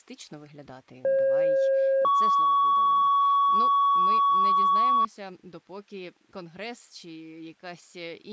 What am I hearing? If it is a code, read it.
Two-tone page, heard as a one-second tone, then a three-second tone, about 540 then 1120 Hz, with speech in Ukrainian.